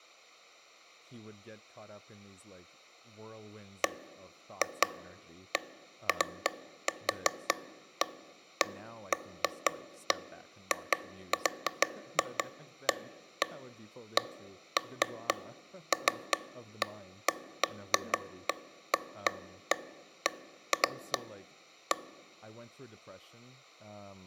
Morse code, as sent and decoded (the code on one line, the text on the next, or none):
none